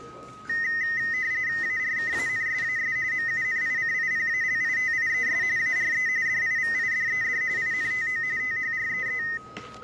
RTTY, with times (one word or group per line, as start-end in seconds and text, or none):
1.6-3.0 ARKANSAS
3.1-5.4 MUNICIPALITIES
5.6-6.1 ARE
6.3-7.4 DIVIDED
7.6-8.2 INTO
8.4-9.2 THREE